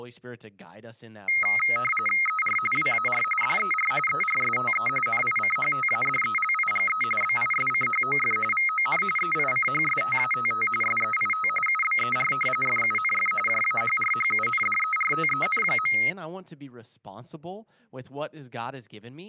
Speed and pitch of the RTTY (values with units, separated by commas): 45.45 baud, 850 Hz shift, 1700 Hz centre